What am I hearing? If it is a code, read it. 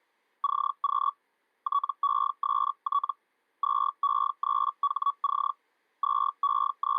Hellschreiber (Feld-Hell, 122.5 baud), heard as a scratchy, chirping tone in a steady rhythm, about 1130 Hz. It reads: CQ TEST 2E3HC …